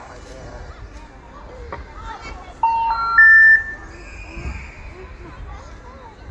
Telephone call progress tone (North American plan), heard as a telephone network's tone, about 910, 1370, 1800 Hz, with room echo and the noise of a park. Special information tone.